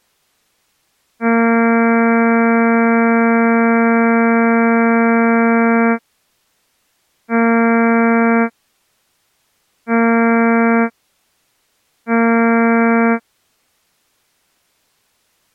Ship horn signal, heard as a ship's horn, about 230 Hz. 1 long, 3 short. At sea: a vessel under tow in fog.